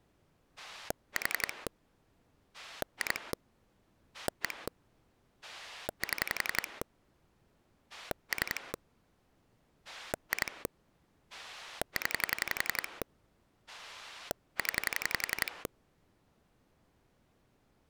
Pulse dialling, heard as a rotary dial, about 11 pulses a second. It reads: 4 2 1 7 3 2 0 0